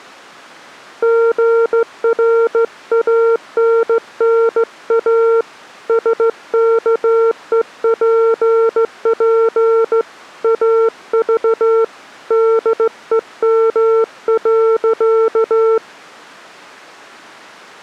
Morse code, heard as a keyed tone, hand-sent with a straight key, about 15 wpm, 450 Hz. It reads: GRANNA SKEPP AV DEM.